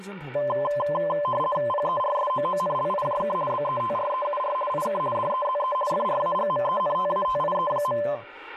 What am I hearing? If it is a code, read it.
RTTY (50 baud, 450 Hz shift), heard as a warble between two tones, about 810 Hz centre, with radio static and speech in Korean. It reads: PERSOONLIJK BETREUR IK DEZE FRAGMENTATIE.